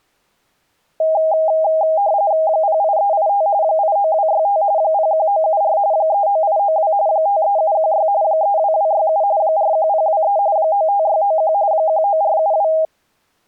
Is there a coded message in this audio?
Yes: RTTY (45.45 baud, 170 Hz shift) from 1.0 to 12.9 s, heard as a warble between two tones, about 720 Hz centre. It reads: 08385 89265 01974 39892 53716 32267 41023 95691 19472